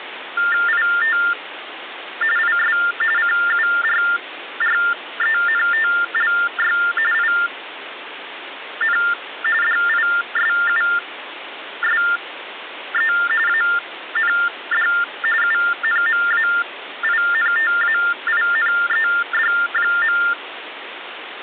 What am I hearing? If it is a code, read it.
TTY/TDD text telephone tones (45.45 baud Baudot), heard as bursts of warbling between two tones, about 400 Hz shift, 1600 Hz centre, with phone line noise. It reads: IT IS CURRENTLY IN DISUSE AND UNMAINTAINED.